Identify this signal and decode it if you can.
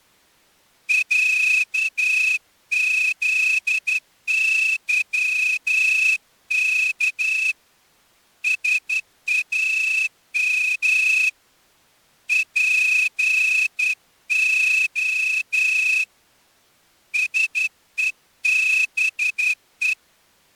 Morse code (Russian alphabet), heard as a whistle, hand-sent with a straight key, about 11 wpm. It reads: ЯЗЫК САМ ПО СЕБЕ